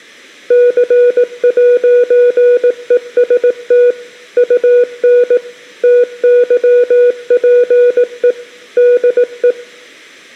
Morse code, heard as a keyed tone, machine-sent, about 18 wpm, 490 Hz. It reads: C'EST UN TYPE DE